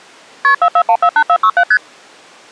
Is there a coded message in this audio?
Yes: multi-frequency trunk signalling (R1, as on North American trunks) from 0.4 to 1.8 s, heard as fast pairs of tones, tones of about 70 ms. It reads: KP 44148467 ST